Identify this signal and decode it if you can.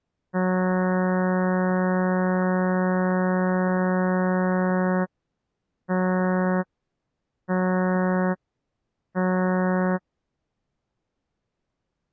Ship horn signal, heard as a ship's horn, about 180 Hz. 1 long, 3 short. At sea: a vessel under tow in fog.